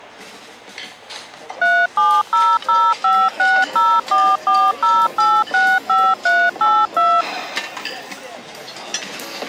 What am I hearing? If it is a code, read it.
DTMF, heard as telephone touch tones, dialled by machine, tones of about 240 ms, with the noise of a restaurant. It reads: 3700560440865382